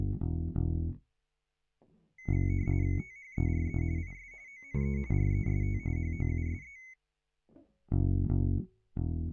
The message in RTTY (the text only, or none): THERE IS ONE REST HOUSE